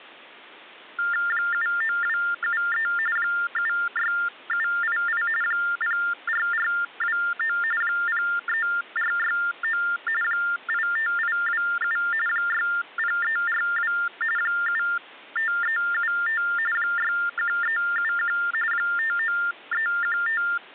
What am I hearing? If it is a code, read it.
TTY/TDD text telephone tones (45.45 baud Baudot), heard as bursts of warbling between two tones, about 400 Hz shift, 1600 Hz centre. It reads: 79273 76788 04429 03469 85827 60342 75375 61371 59315